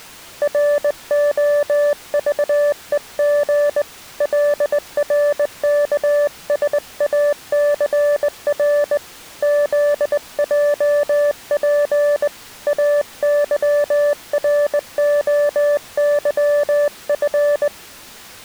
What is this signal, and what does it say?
Morse code, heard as a keyed tone, hand-sent with a straight key, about 20 wpm, 580 Hz. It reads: ROVEG LRKSACR ZJP AYROYF